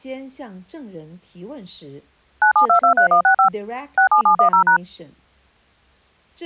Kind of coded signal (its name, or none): DTMF